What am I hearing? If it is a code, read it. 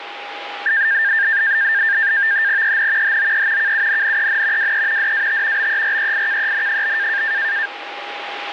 NAVTEX (SITOR-B), 100 baud, 170 Hz shift, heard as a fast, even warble, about 1700 Hz centre, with radio static and a steady whistle near 820 Hz. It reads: EN HOE KUNNEN WE DAT BEREIKEN?